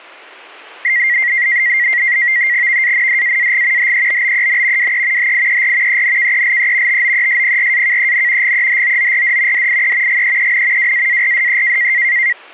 NAVTEX (SITOR-B), 100 baud, 170 Hz shift, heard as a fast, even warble, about 2000 Hz centre, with static crashes. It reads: VANDAAG HEBBEN WE HIER ENKELE TOESPRAKEN GEHOORD DIE GEEN WAARDE